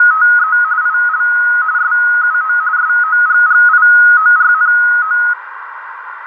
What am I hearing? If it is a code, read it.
RTTY (45.45 baud, 170 Hz shift), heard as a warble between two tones, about 1360 Hz centre, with radio static, a narrow filter and room echo. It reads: … IL SUO SOGGIORNO